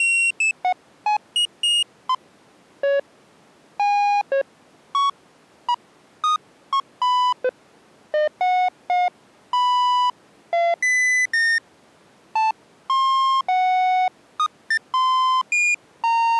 Electronic bleeps of random pitch and length. There is no code.